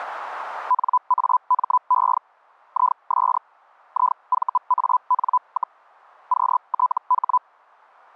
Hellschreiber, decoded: NAME IS IVAN, QTH

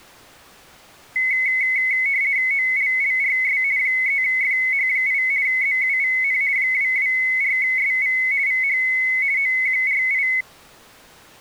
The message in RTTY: OLLRS 3FH8 ZUVN 224SV VH OQRI

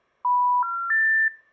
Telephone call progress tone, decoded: special information tone

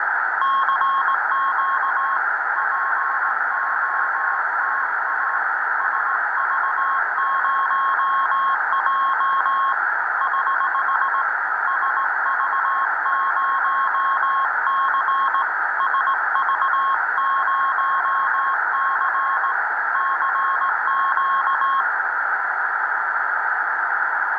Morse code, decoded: CQ POTA SV0J <HH> SV0C SV0C CQ

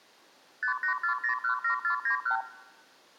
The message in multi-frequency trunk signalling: 584017491

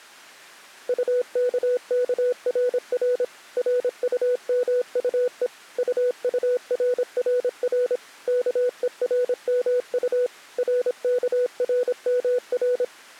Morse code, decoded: UKKRR RUMUE UURRR KERMU RKRMR

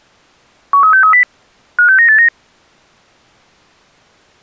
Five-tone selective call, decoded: 13630 56989

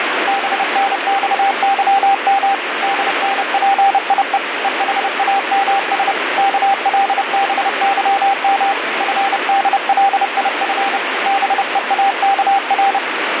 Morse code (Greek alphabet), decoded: ΒΝΞΥΜ ΔΝΠΙΕ ΕΗΑΜΣ ΚΛΒΥΜ ΦΔΛΙΦ ΒΕΑΚΡ

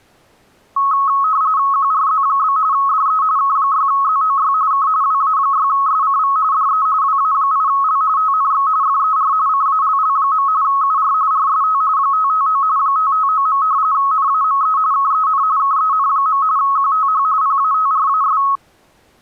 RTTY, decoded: QRZ? DE K6ZOY K WA6SCV DE WA8L TNX FER CALL. UR RST 559 559. NAME KEN KEN. QTH PATRAS

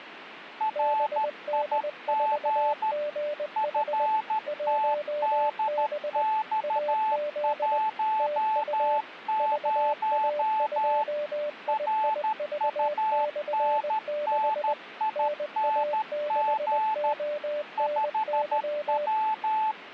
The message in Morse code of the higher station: RIG FTDX10 RUNNING 5W

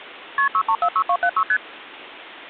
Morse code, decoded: none

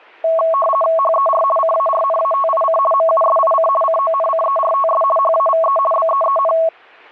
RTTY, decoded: HER CARNATIC MUSIC CONCERTS HAVE BEEN

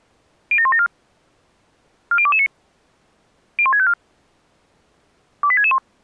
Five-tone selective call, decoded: 07174 40229 01654 28661

